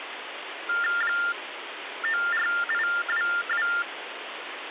TTY/TDD text telephone tones (45.45 baud Baudot), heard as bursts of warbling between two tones, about 400 Hz shift, 1600 Hz centre, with phone line noise. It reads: 94822